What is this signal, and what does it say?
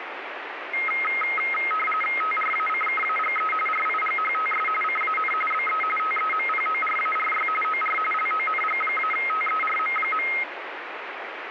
RTTY (45.45 baud, 850 Hz shift), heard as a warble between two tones, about 1700 Hz centre, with radio static. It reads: TRACKAGE RIGHTS CAN BE TEMPORARY OR LONG-TERM.